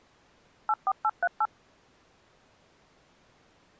DTMF, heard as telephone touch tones, dialled by machine, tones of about 50 ms. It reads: 84838